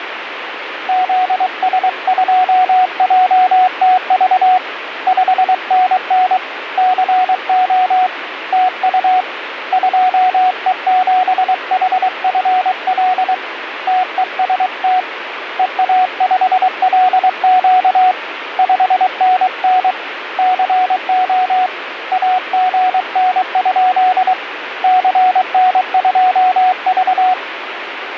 Morse code, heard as a keyed tone, hand-sent with a paddle, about 23 wpm, 740 Hz, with radio static. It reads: ZS2JTV 5NN CO TU 2E7HFL TEST EA5LQ 5NN CO AGN? CN2V